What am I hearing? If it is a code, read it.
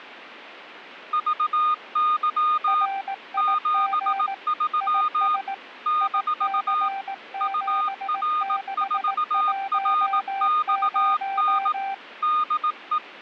Morse code, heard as two keyed tones. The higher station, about 18 wpm, 1230 Hz: VY 73 - UR4RXN DE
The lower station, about 18 wpm, 780 Hz: RIG IS IC7610